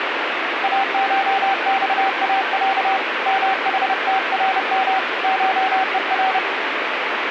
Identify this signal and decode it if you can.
Morse code (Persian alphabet), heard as a keyed tone, hand-sent with a paddle, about 30 wpm, 770 Hz, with radio static. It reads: اشخاص محترم شهر